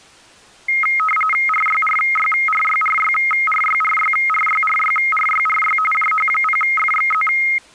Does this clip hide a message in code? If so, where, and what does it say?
Yes: RTTY (45.45 baud, 850 Hz shift) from 0.7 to 7.6 s, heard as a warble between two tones, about 1700 Hz centre. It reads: RYRYRYRYRYRYRYRYRYRY JH0FXZ